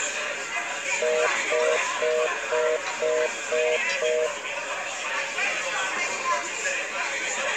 Telephone call progress tone (North American plan), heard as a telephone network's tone, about 480, 620 Hz, 0.25 s on and 0.25 s off, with the noise of a crowd indoors. Congestion tone.